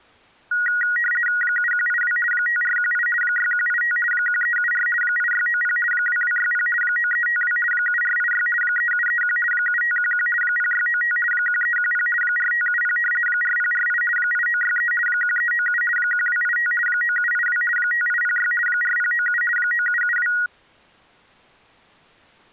RTTY (50 baud, 450 Hz shift), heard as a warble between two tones, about 1700 Hz centre. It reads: 7182 5418 6185 1374 8690 2260 9352 7486 3731 7511 0695 1310 4570 4048 8963 1397 1285 9782 5806 4097 9772